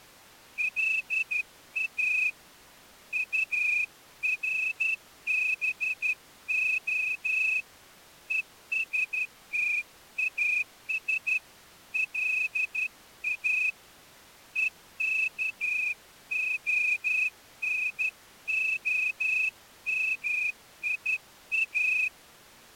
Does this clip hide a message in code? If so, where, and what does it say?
Yes: Morse code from 0.5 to 22.1 s, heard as a whistle, hand-sent with a straight key, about 12 wpm. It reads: LA URBO ESTAS LA EKONOMIA